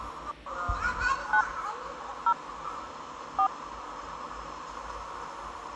DTMF, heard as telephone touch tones, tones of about 80 ms, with the noise of a park. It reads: 9 0 4